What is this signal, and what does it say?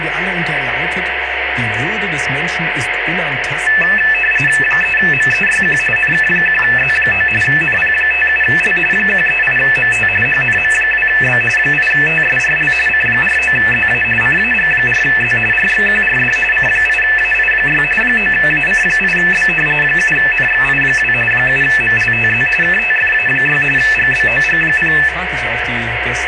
RTTY (45.45 baud, 850 Hz shift), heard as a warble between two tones, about 2200 Hz centre, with radio static. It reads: 3MEYQ NK1Z9 NP57L 138MT HNM2B 8TSRL C49ZA CAG4Z RXQRD C8AI6 9AC8B 7NXI2 7MLTZ KTFA6 GBOG0